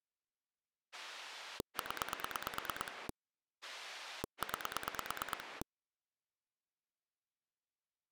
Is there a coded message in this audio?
Yes: pulse dialling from 0.9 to 5.6 s, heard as a rotary dial, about 9 pulses a second. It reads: 0 9